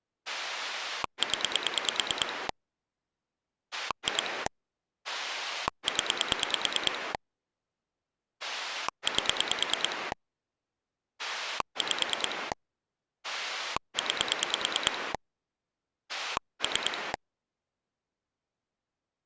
Pulse dialling, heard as a rotary dial, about 9 pulses a second. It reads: 0 2 0 8 5 9 3